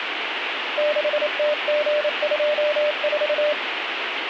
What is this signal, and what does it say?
Morse code, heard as a keyed tone, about 28 wpm, 600 Hz, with radio static. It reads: 6TG24